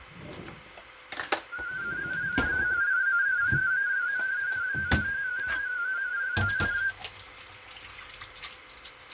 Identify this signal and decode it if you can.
Multi-tone FSK (Olivia or MFSK type), about 250 Hz wide, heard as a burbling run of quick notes, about 31.25 baud, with radio static, fading, a steady whistle near 510 Hz and kitchen noise.